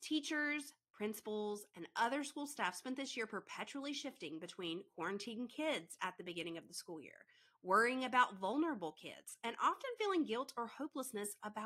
Speech in English. There is no code.